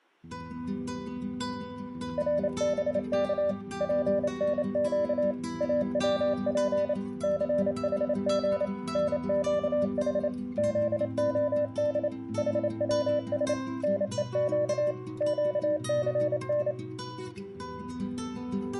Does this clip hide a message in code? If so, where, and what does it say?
Yes: Morse code (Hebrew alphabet) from 2.1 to 16.8 s, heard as a keyed tone, machine-sent, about 28 wpm, 590 Hz. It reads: רבך פנק אצף סחג נקח זהד חצש נוק קסן